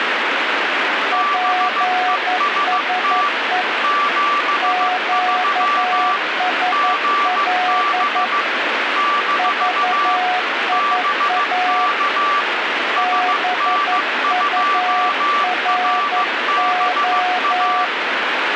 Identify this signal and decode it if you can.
Morse code, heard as two keyed tones, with radio static. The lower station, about 11 wpm, 730 Hz: PSE QSL VIA BURO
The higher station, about 15 wpm, 1160 Hz: BEST 73 GB - BK SN2RBA